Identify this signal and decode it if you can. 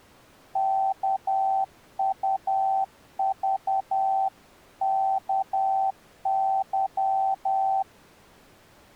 Morse code (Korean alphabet), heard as a keyed tone, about 10 wpm, 770 Hz. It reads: 일에